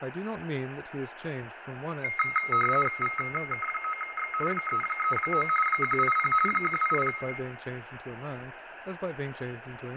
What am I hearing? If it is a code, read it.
RTTY (45.45 baud, 850 Hz shift), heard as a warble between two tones, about 1700 Hz centre, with radio static, fading, room echo and speech in English. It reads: VK9X 339 180 180